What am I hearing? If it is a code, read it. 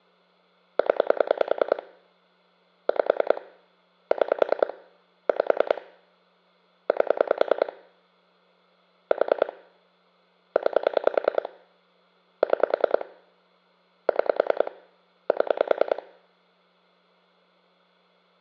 Pulse dialling, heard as clicks on a phone line, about 10 pulses a second. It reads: 0 5 6 5 8 4 9 6 6 7